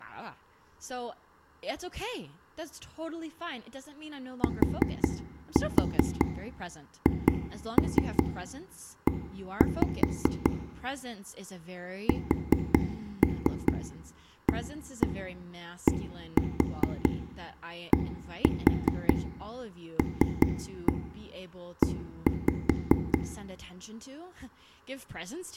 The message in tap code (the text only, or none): THE SADDLE